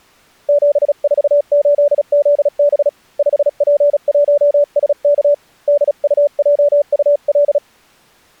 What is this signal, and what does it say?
Morse code, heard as a keyed tone, hand-sent with a paddle, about 36 wpm, 580 Hz. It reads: 748ZB 5P1SK DUJUL